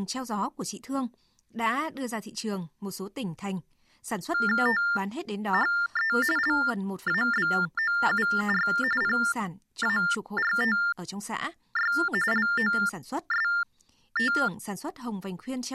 TTY/TDD text telephone tones (45.45 baud Baudot), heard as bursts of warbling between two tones, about 400 Hz shift, 1600 Hz centre, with speech in Vietnamese. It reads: THE LABOUR PARTY LOST